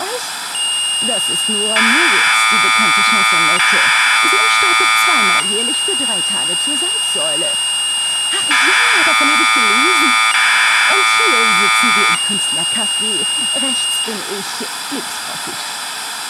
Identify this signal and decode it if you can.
Commodore tape loading (standard loader), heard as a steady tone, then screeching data, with tape hiss.